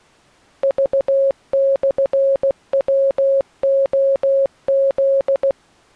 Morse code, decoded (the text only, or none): V/WOZ